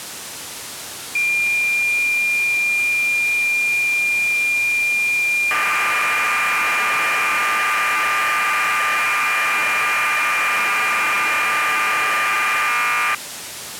Cassette data (Kansas City type), 1200 baud, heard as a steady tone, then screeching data, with tape hiss.